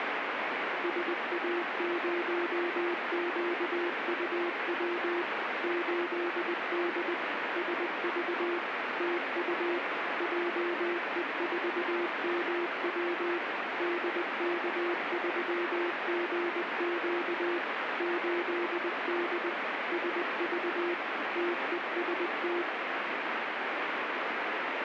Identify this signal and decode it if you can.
Morse code, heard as a keyed tone, machine-sent, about 20 wpm, 350 Hz, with heavy radio static. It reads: SA0QUW 8D SV TU JE4MW DK3GQ 8D SV TEST